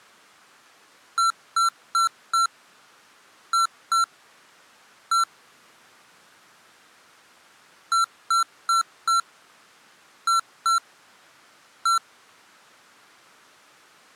Beep code, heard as beeps from a small speaker, played twice, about 1350 Hz. 4-2-1. In Phoenix BIOS tables: timer tick failure.